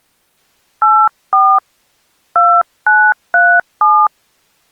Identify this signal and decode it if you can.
DTMF, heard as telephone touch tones, dialled by hand, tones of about 260 ms. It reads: 84 2937